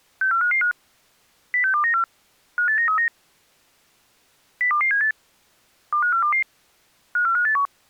Five-tone selective call (CCIR), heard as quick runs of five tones, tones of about 100 ms. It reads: 64555 06294 58939 02278 25422 54581